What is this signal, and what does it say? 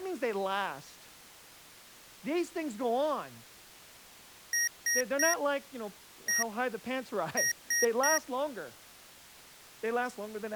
Beep code, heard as beeps from a small speaker, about 1900 Hz, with speech in English. 3-1-3. In Phoenix BIOS tables: interrupt mask register failure.